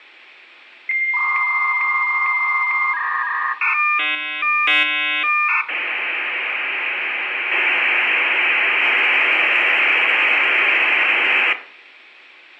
Dial-up modem handshake (V.34 or later), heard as a whistle, warbles, then hiss, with room echo.